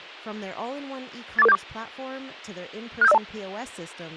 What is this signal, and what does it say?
Five-tone selective call (EIA), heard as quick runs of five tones, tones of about 30 ms, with speech in English. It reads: 84474 67502